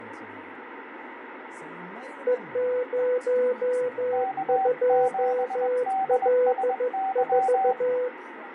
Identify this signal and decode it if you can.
Morse code, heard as two keyed tones, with radio static. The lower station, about 14 wpm, 500 Hz: E02L4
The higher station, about 21 wpm, 770 Hz: K7DSY